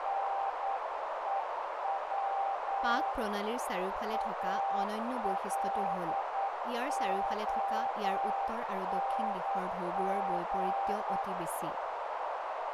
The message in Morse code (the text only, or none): NEW ALONG